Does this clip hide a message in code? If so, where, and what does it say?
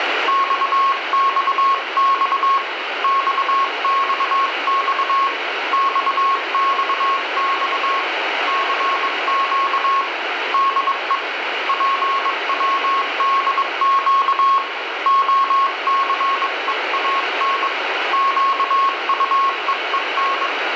Yes: Morse code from 0.2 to 20.5 s, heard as a keyed tone, hand-sent with a bug key, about 22 wpm, 1090 Hz, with radio static and room echo. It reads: XXX XXX XXX CQ DE PWDQ OCEAN QUEEN